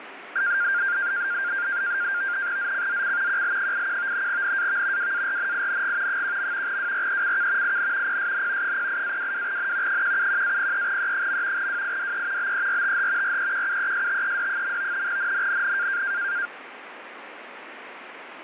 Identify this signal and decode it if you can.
NAVTEX (SITOR-B), 100 baud, 170 Hz shift, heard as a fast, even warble, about 1500 Hz centre, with radio static. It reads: ZCZC QL81 NAV WARNING 1. WRECK IN PSN 08-22N 171-03E. WIDE BERTH REQUESTED. NNNN